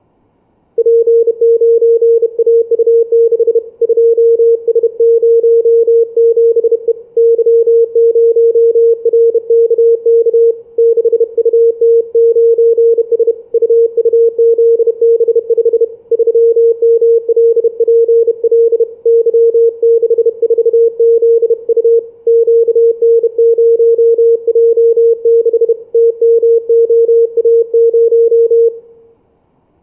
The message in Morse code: P9AU6 2S07E Y0RKK 6UT9S UUZB5 3MLPL Y64ZU QN0J6 TMOA0

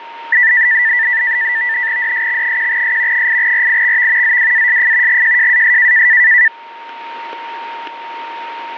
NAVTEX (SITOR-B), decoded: DSX1S 8RIXV ZWASF GJJAS

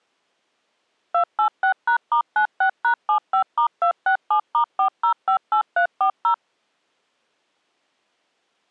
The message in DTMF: 286#*96#75*267*4058340

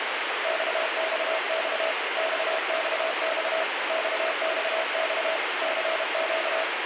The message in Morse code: XXX XXX XXX CQ

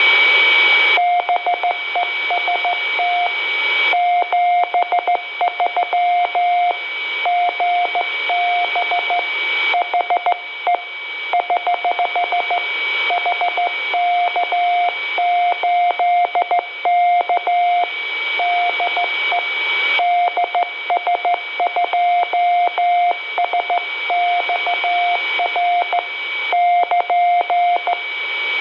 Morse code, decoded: BEST 73 GB HE <HH> HK8K DE DS2SXR <KN>

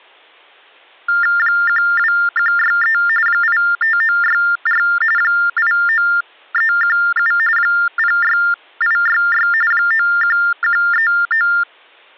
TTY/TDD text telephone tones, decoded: 12163 85964 89317 06866 91139

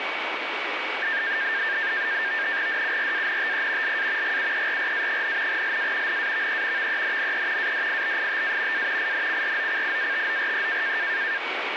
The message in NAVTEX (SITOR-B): DURANTE LA GUERRA, LA NAVE VENNE ADIBITA A INCROCIATORE

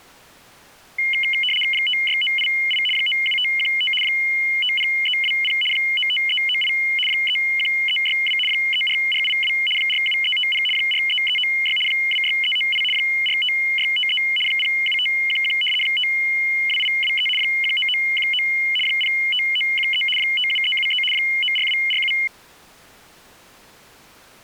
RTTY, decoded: 56988 97515 50320 95398 31362 34482 47350 43396 26398 45653 07511 52823 19919 05913 57373 94247

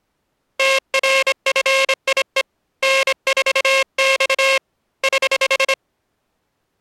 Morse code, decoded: TRFIE N4X <HH>

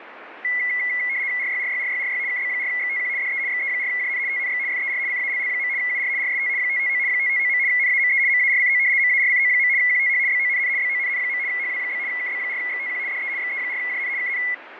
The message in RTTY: RYRYRYRY KB4XTQ DE XE4JN TNX FER CALL. UR RST 559 559. NAME MARCO MARCO. QTH BONN BONN. HW? KB4XTQ DE XE4JN KN

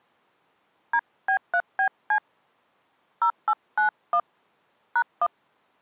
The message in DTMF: DB3BC 0891 #1

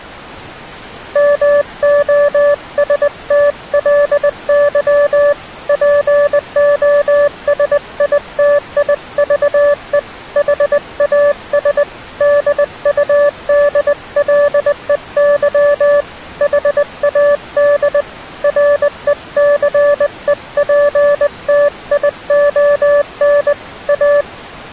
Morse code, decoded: MOSTLY POSITIVE HAS DUDLEY HAD RECEPTION A

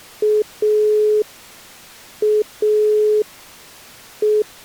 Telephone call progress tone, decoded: dial tone

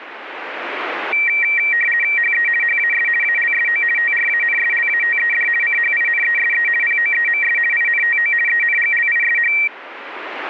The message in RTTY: HE HAS ALSO TRANSLATED CHINESE POEMS INTO ENGLISH

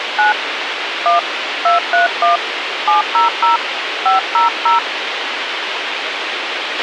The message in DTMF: 9 1 231 700 500

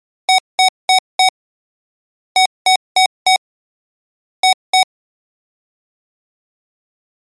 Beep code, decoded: 4-4-2

